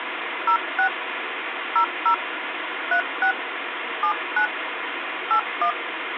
DTMF, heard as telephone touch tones, dialled by hand, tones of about 90 ms, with phone line noise. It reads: 06 00 36 79 81